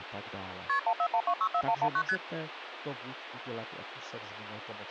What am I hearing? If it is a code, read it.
Multi-frequency trunk signalling (R1, as on North American trunks), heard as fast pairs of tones, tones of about 70 ms, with phone line noise and speech in Czech. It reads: KP 141264119 ST